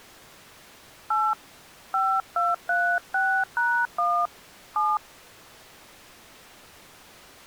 DTMF, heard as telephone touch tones, dialled by hand, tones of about 240 ms. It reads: 8 5236#1 7